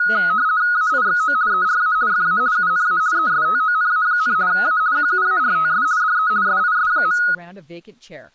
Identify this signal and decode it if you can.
RTTY (50 baud, 170 Hz shift), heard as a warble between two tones, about 1360 Hz centre, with speech in English. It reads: AIXO ERA FA UNA ESTONA, A QUARTS DE SIS.